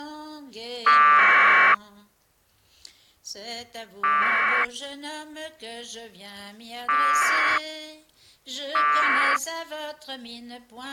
Packet radio (AX.25, as in APRS), 1200 baud, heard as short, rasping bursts.